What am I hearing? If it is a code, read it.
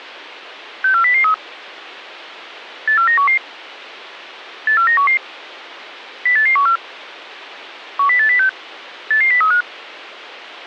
Five-tone selective call (CCIR), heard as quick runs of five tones, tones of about 100 ms. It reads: 64003 84911 84911 08814 10806 88035